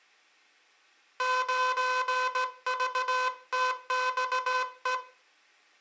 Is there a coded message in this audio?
Yes: Morse code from 1.1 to 5.0 s, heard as a buzzer, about 17 wpm. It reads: 9VTXE